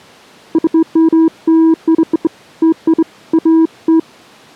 Beeps of irregular length. There is no code.